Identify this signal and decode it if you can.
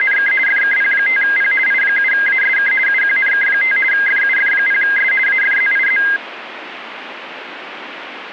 RTTY (50 baud, 450 Hz shift), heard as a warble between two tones, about 1850 Hz centre, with radio static. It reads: … FKP5P I7ASK UQNK5 FUF0S AFZIZ